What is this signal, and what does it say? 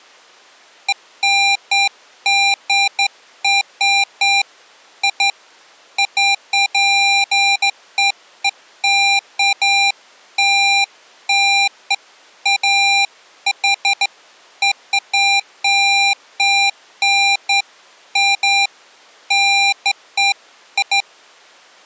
Beeps of irregular length. There is no code.